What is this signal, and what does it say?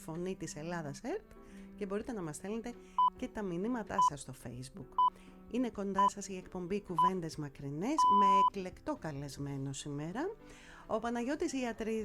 Radio time signal (six pips, as the Greenwich Time Signal), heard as pips.